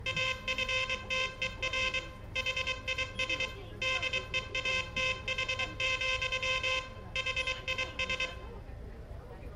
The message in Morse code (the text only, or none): AFTER HIS DEATH, HIS